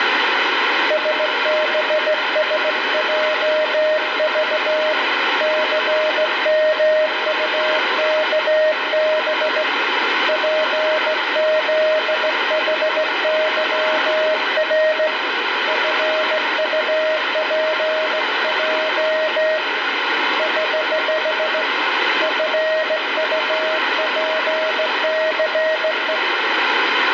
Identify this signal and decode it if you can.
Morse code, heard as a keyed tone, hand-sent with a straight key, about 16 wpm, 620 Hz, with radio static and room echo. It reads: SBSJV CMUKB PZHYR FUPJ <HH> FUPCE